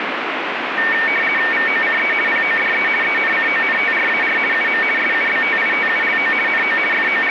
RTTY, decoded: VOCE PODE ENCONTRAR UM SUBTITULO NO …

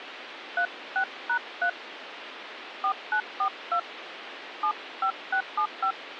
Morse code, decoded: none

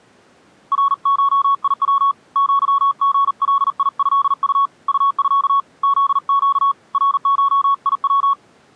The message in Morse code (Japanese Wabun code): ナゴヤ アリガトウ ウミ フネ ナゴヤ

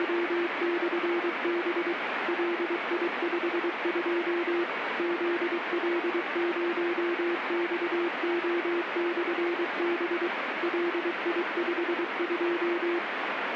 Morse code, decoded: … LI52 ZL0XO/B LI52

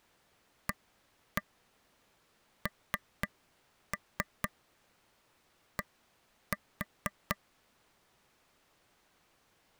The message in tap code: AND

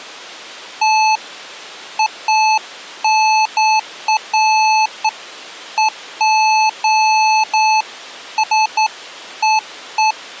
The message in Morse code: none

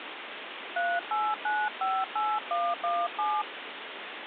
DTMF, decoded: 38958117

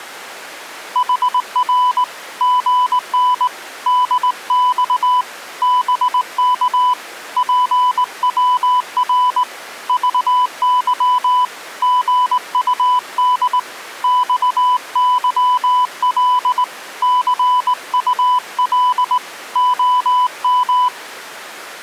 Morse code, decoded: HR GN DX BK PWR VY GUD XYL CUL OM

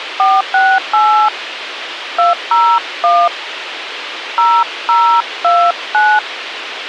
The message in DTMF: 468 201 0029

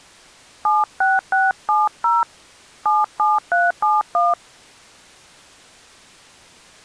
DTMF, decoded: 76670 77371

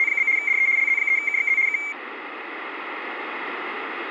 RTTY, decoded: … DE LZ3KXZ K

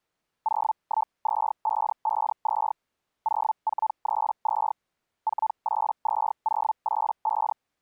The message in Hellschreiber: 012552 0432 482085

